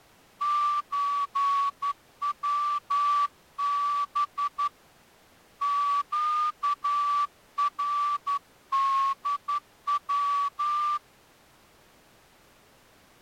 Morse code (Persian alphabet), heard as a whistle, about 11 wpm. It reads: چوب گردو